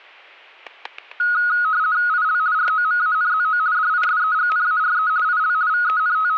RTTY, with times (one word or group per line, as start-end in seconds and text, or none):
2.1-2.4 IL
2.5-3.6 ROMANZO
3.7-5.1 DISEGNARE
5.2-5.5 IL
5.7-6.4 …